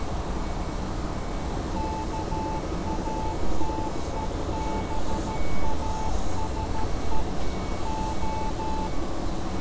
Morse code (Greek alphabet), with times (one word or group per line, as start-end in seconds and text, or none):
1.8-7.2 ΚΑΤΕΒΑΣΕ
7.9-8.9 Ο